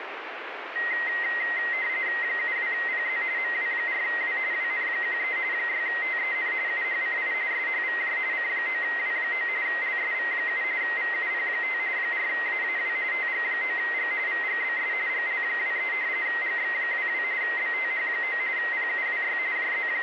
RTTY (45.45 baud, 170 Hz shift), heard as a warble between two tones, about 2000 Hz centre, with radio static. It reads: 72PZ MW4W WN13 6TEN UHCI SHVJ C9W9 LSV7 VUP5 4AAW TG9G VGBS GL23 GX22 BTH9 PUWY …